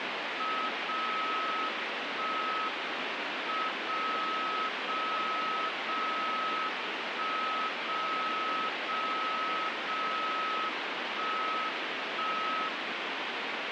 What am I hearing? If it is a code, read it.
Radio time signal (WWVB), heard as a tone whose level steps once a second, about 1280 Hz, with radio static. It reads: 0 1 M 0 0 0 1 0 0 0 1 1